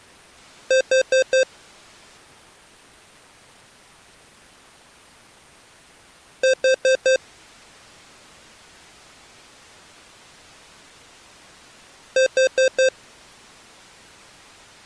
Alarm pattern, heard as an alarm's beeps, played three times, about 520 Hz. Temporal four. Carbon monoxide.